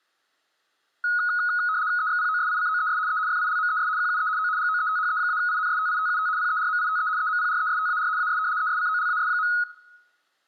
RTTY (75 baud, 170 Hz shift), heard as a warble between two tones, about 1360 Hz centre, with room echo. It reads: EXPOSICOES E FILMES QUE O GOETHE-INSTITUT PERMITE EMPRESTAR AS ESCOLAS.